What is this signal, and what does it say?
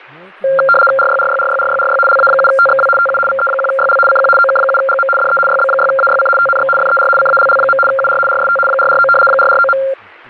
RTTY (75 baud, 850 Hz shift), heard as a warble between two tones, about 960 Hz centre, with speech in English. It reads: RYRYRYRYRY LA7TXW TU VE1YL CQ OK7GM DE YB6AYC TNX FER CALL. UR RST 449 449.